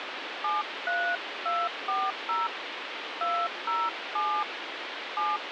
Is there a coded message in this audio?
Yes: DTMF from 0.4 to 5.4 s, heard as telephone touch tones, dialled by hand, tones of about 240 ms, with phone line noise. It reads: 73240 207 7